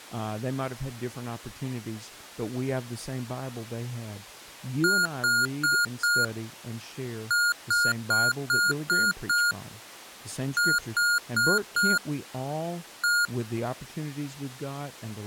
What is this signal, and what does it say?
Beep code, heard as beeps from a small speaker, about 1420 Hz, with speech in English. 4-6-4-1.